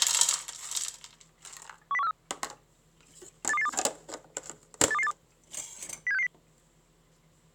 Five-tone selective call (EEA), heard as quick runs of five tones, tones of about 40 ms, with kitchen noise. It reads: 10143 82282 82282 07660